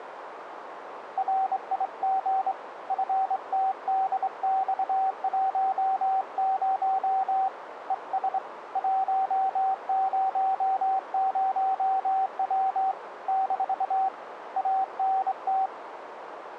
Morse code, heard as a keyed tone, hand-sent with a straight key, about 25 wpm, 770 Hz, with radio static and a narrow filter. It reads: RIG FTDX10 ES 100W - ANT